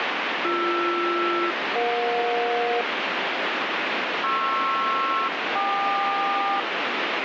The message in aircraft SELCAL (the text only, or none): BR-EJ PR-KQ